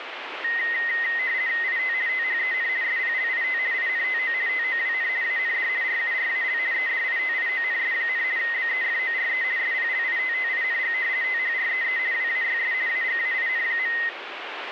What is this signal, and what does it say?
RTTY (50 baud, 170 Hz shift), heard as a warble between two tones, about 1950 Hz centre, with radio static. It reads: IT THEN SPLIT INTO TOWN AND RURAL EDITIONS, BEFORE SPLITTING THREE WAYS AGAIN.